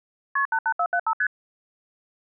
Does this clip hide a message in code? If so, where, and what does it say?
Yes: multi-frequency trunk signalling (R1, as on North American trunks) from 0.4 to 1.3 s, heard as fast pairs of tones, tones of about 70 ms. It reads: KP 88475 ST